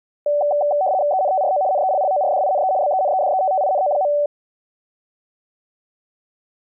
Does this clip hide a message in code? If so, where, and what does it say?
Yes: RTTY (75 baud, 170 Hz shift) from 0.3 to 4.3 s, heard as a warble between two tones, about 670 Hz centre. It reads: ENTRO NELLORDINE BENEDETTINO.